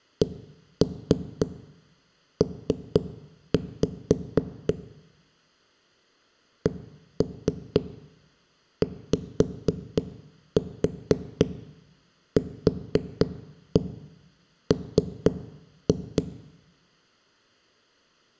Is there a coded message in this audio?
Yes: tap code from 0.2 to 16.3 s, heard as knocks on a wall, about 4 knocks a second, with room echo. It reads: CP CYQM